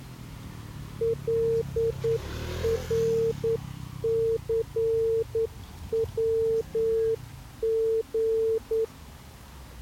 Morse code (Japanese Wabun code), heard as a keyed tone, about 9 wpm, 450 Hz, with the noise of a residential street. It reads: カナニヤリ